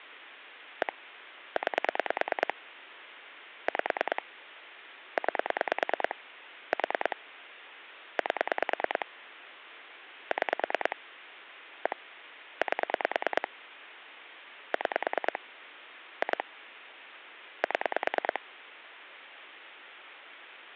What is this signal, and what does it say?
Pulse dialling, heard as clicks on a phone line, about 9 pulses a second, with phone line noise. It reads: 1 9 5 9 4 8 6 1 8 6 2 7